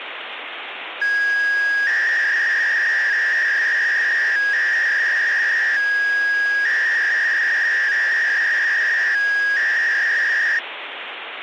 300-baud modem data (V.21 tones), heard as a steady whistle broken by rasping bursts, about 300 baud, 200 Hz shift, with phone line noise.